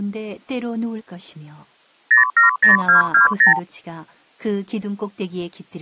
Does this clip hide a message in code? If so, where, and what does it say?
Yes: multi-frequency trunk signalling (R2, with the far end's replies) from 2.1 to 3.6 s, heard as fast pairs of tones, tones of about 130 ms, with speech in Korean. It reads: 070220